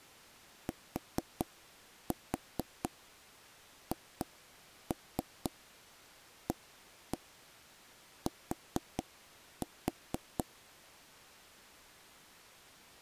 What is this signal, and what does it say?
Tap code, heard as knocks on wood, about 4 knocks a second. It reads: THAT